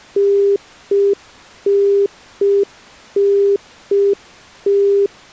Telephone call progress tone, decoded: congestion tone

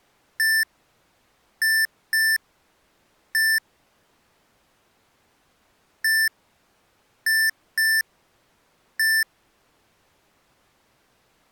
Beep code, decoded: 1-2-1

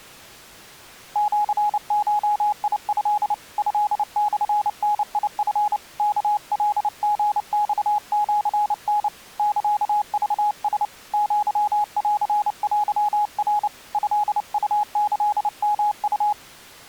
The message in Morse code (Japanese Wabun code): シゴト トモダチ ワカリマシタ サクラ アンテナ トウキヨウ

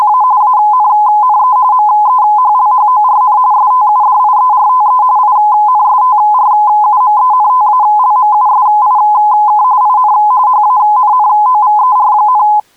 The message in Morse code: none

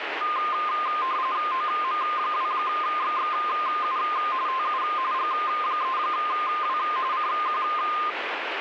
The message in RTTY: OM2XXU TU G3W CQ

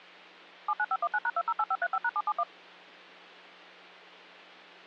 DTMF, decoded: 79519#208535#771

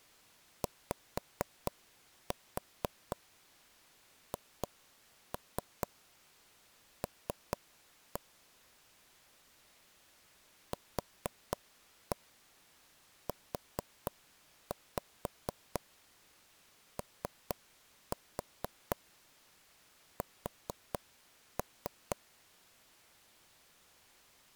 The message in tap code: YHL QUOS

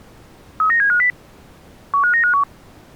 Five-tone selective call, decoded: 39750 15951

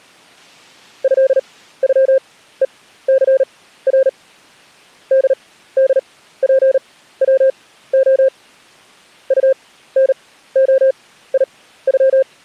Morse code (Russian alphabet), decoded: ЭЮЕЦР ДДПВО УНОИЮ

